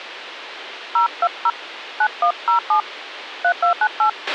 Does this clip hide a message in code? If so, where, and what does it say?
Yes: DTMF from 1.0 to 4.1 s, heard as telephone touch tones, dialled by hand, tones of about 80 ms, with radio hiss and a squelch burst at the end. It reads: 020 9107 3298